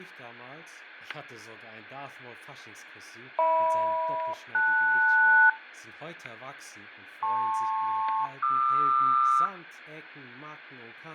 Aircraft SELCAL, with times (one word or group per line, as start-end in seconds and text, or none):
3.4-5.5 HM-LS
7.2-9.5 LP-QR